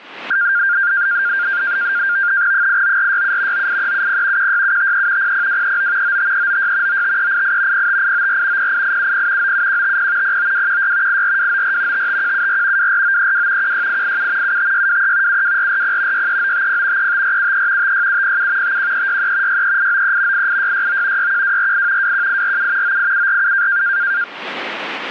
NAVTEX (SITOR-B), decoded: 89467 98370 16753 00239 95396 95388 05894 08870 97150 09216 84294 55174 24932 16887 75623 72440 63950 35473 56707 51363 63893 88669 61248 21847 98747

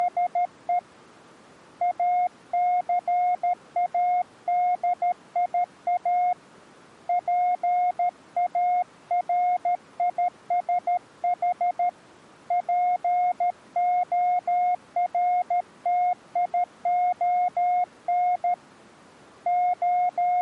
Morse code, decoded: … ACADIA PARISH PORTION …

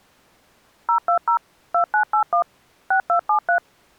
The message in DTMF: 020 2981 6273

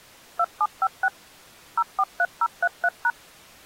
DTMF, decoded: 2756 043033#

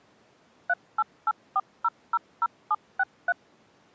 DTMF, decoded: 3884000763

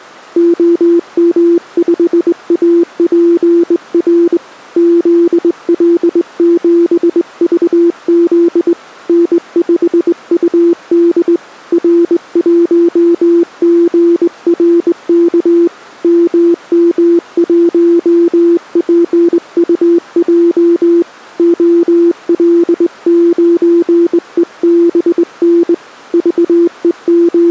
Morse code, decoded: OM5APR ZL7VZ N5UD R1GRK MM1PUJ OL9EBN …

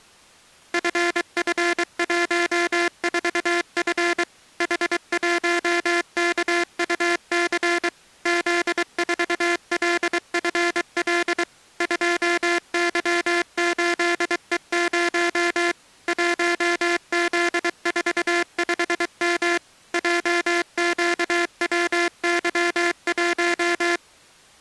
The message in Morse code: FF14F H1KUC Z4LFL 2Y8E0 1Z45M JQWY1

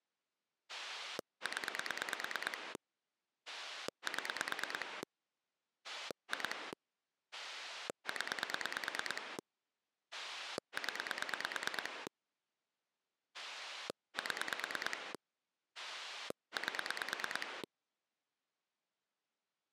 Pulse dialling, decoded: 0 7 2 0 0 7 8

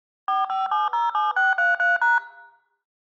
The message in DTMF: 45707633#

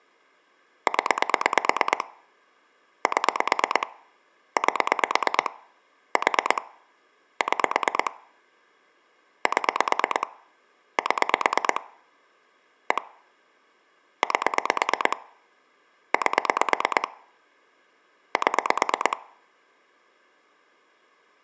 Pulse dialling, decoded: 0 7 8 4 6 7 7 1 8 8 7

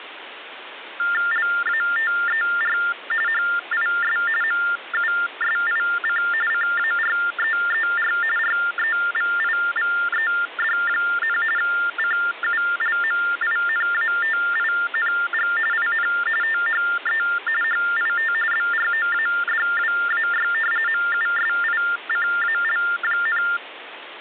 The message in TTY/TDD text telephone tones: LATER HIS MUSIC CAREER REVIVED, CULMINATING IN THE HIT BROADWAY MUSICAL,

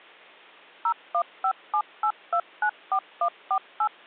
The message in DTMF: 01578294148

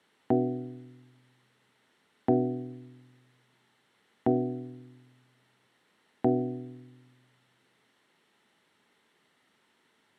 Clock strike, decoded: 4

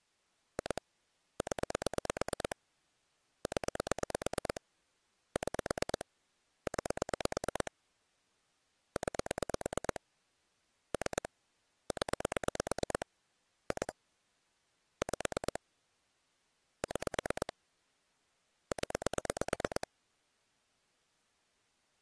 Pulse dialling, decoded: 2 0 0 6 9 9 3 0 2 5 6 0

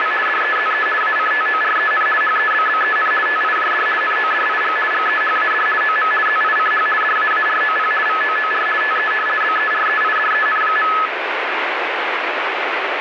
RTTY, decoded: … DEZE ACTOREN HEBBEN TIJD NODIG GEHAD OM ZICH DAAROP VOOR TE BEREIDEN.

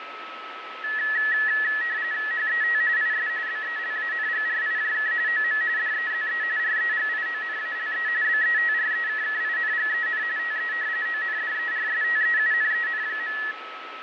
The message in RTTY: HET IS BELANGRIJK OM DEZE REGIONALE BETREKKINGEN TE ONDERSTEUNEN.

